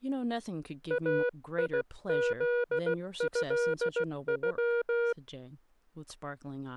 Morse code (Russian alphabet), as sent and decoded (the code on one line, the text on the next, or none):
.- .. --.. ..-.. ..--
АИЗЭЮ